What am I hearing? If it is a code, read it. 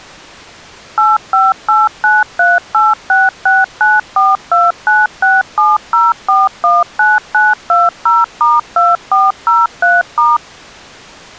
DTMF, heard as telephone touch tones, dialled by machine, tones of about 190 ms. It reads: 858938669429670419920*2403*